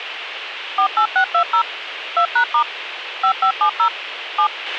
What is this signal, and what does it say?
DTMF, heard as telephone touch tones, dialled by machine, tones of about 90 ms, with radio hiss and a squelch burst at the end. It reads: 48620 2#* 5570 7